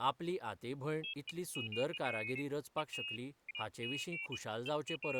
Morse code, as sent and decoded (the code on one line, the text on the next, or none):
none